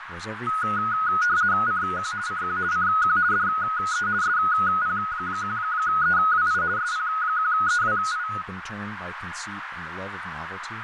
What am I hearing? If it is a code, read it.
RTTY (50 baud, 170 Hz shift), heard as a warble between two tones, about 1360 Hz centre, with radio static, a narrow filter and speech in English. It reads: CQ CQ CQ DE SP1EWI SP1EWI